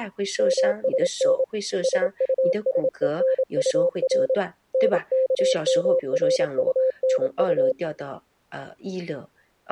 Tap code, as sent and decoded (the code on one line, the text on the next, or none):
none